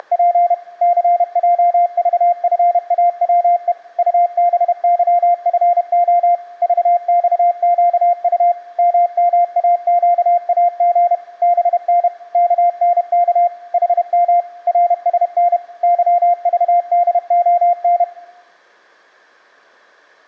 Morse code, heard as a keyed tone, machine-sent, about 31 wpm, 700 Hz. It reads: … CJVFAWE UBYFO VXQU MMAQAG BN KNK HM RSN YVDON